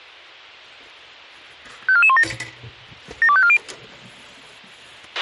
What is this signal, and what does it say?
Five-tone selective call (ZVEI), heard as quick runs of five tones, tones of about 70 ms, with a squelch burst at the end and kitchen noise. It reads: 54417 72540